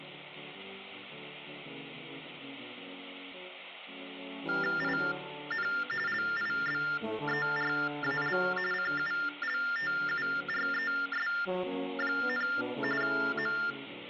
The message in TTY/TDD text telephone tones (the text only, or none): IN LIBERAL CULTURES, …